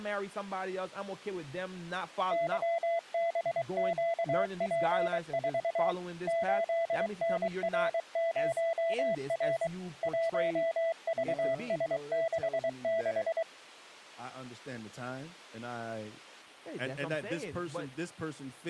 Morse code, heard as a keyed tone, machine-sent, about 23 wpm, 670 Hz, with speech in English. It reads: YBQP4 8NR0R 1VS66